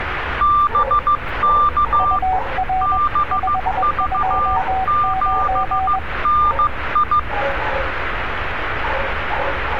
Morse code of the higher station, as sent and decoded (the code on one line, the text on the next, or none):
-... -.- / -... ...- --... -. ..
BK BV7NI